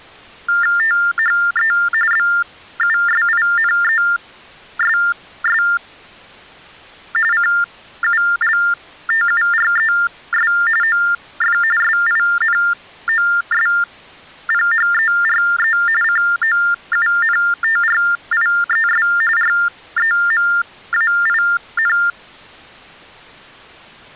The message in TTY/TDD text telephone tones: THE BUSINESS CULTURES OF SINOSPHERE COUNTRIES REMAIN

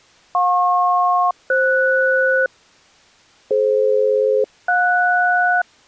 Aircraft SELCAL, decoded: JP-FS DF-JS

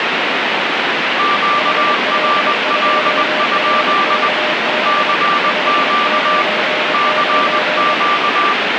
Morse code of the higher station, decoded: QRL? CQ CQ

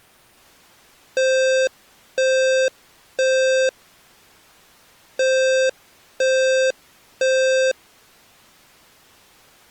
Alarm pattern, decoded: temporal three

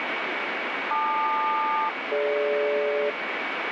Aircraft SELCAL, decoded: LQ-DG

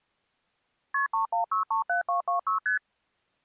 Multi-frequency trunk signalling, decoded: KP 31637226 ST

